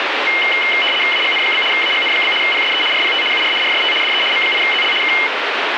RTTY (75 baud, 850 Hz shift), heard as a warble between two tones, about 2550 Hz centre, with radio static. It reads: AGN? AGN? PSE RPT UR RST DE M8ZL K